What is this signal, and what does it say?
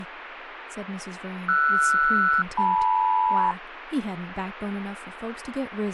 Aircraft SELCAL, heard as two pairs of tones, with radio static and speech in English. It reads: RS-LM